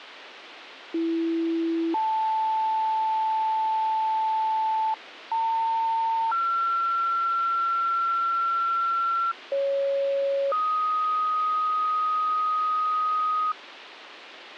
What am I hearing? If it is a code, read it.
Two-tone page, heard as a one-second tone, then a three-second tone, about 330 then 880 Hz, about 900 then 1360 Hz, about 550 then 1250 Hz, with radio hiss.